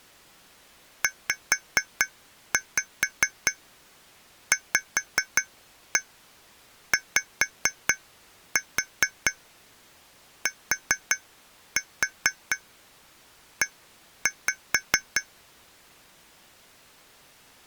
Tap code, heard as taps on glass, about 4 knocks a second. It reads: ZVYTE